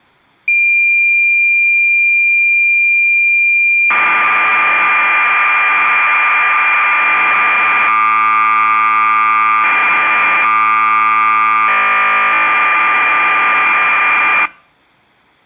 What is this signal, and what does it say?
Cassette data (Kansas City type), 1200 baud, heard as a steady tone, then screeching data.